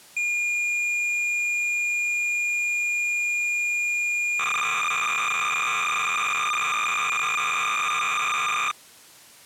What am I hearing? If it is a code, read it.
Cassette data (Kansas City type), 300 baud, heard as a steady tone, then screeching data.